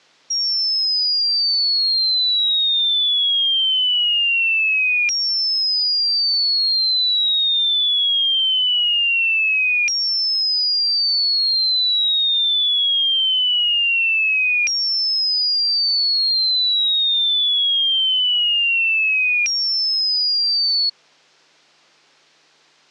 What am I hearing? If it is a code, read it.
A tone that sweeps in pitch again and again. There is no code.